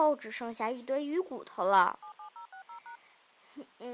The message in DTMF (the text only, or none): 77060#